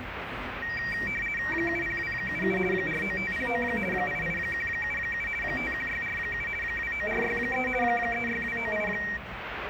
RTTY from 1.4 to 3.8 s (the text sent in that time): 70277 49509